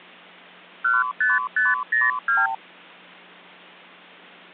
Multi-frequency trunk signalling (R2, with the far end's replies), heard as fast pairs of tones, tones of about 180 ms. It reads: 15502